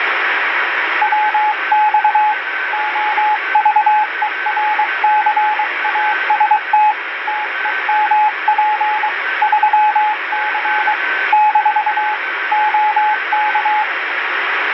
Morse code, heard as a keyed tone, hand-sent with a paddle, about 23 wpm, 850 Hz, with radio static and a weaker station near 1540 Hz. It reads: WX OVERCAST TEMP 3C - OK